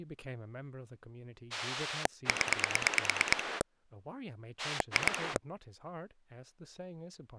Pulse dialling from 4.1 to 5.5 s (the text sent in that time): 2